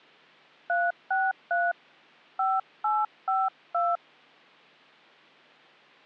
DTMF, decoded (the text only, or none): 363 5852